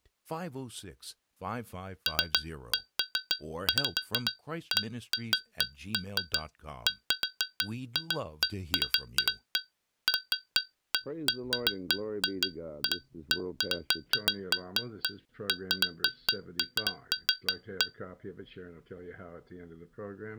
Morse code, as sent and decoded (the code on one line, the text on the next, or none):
none